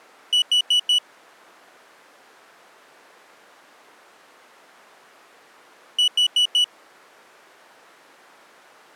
Alarm pattern, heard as an alarm's beeps, played twice, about 2950 Hz. Temporal four. Carbon monoxide.